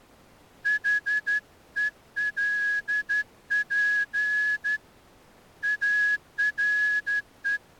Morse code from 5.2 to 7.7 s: ARE

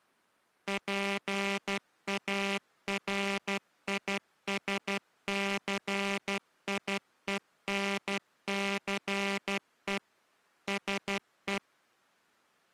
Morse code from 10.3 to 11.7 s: SE

